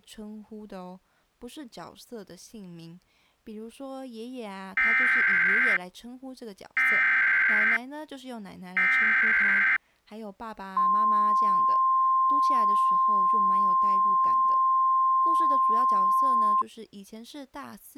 Emergency Alert System (SAME) tones (header bursts, then the 1050 Hz attention tone), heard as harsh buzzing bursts, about 520.83 baud, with speech in Chinese.